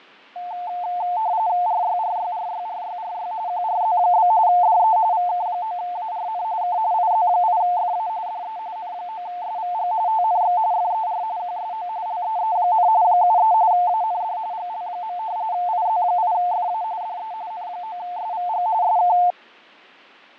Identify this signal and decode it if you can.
RTTY (45.45 baud, 170 Hz shift), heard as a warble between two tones, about 800 Hz centre, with fading. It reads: RYRYRYRYRY QRZ? DE VK9ARN K IZ8FA DE N9SVG TNX FER QSO LEE, 73 AND GL. IZ8FA DE N9SVG SK